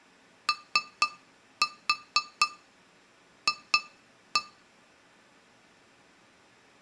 Tap code, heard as taps on glass, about 4 knocks a second. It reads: OF